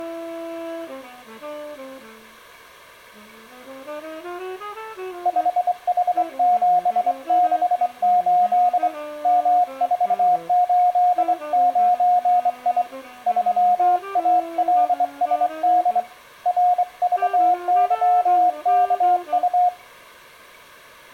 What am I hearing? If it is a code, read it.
Morse code, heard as a keyed tone, hand-sent with a straight key, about 24 wpm, 720 Hz. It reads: 5H768 M489I 3ALSD RVYKU